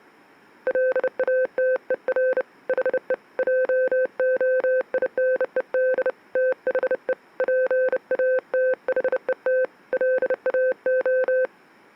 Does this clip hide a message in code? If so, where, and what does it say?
Yes: Morse code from 0.6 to 11.5 s, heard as a keyed tone, hand-sent with a bug key, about 30 wpm, 510 Hz. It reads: LATER HE JOINED THE PATHET LAO